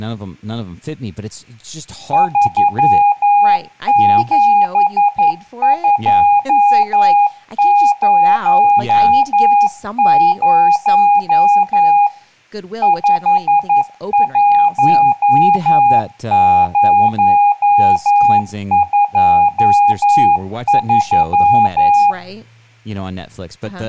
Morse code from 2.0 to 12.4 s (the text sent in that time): 37200